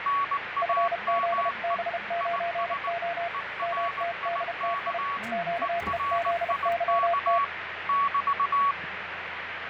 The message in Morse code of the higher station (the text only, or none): NAME IS ERIK ERIK <BT>